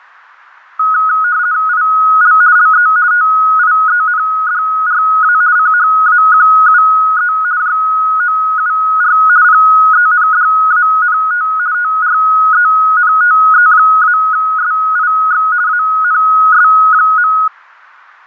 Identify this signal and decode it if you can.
RTTY (50 baud, 170 Hz shift), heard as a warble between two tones, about 1360 Hz centre. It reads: IL LE TIENDRA CHAQUE JOUR PENDANT TRENTE-SIX ANS.